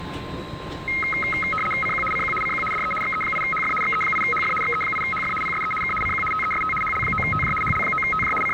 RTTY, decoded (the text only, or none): CQ CQ CQ DE XE8HF XE8HF XE8HF PSE K CQ TEST HL9TJ HL9TJ …